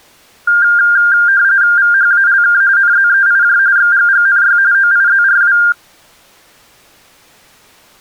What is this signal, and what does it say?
RTTY (45.45 baud, 170 Hz shift), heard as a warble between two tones, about 1500 Hz centre. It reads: VHALK NZEIJ XGGNY OIZRW